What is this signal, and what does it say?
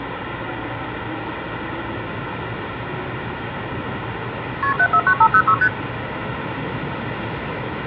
Multi-frequency trunk signalling (R1, as on North American trunks), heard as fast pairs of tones, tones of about 70 ms, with phone line noise and the noise inside a subway train. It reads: KP 749506 ST